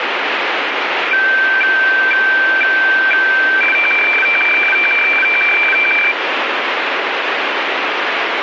Weather fax (radiofax), 120 lines a minute, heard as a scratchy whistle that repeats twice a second, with radio static.